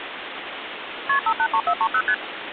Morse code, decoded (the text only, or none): none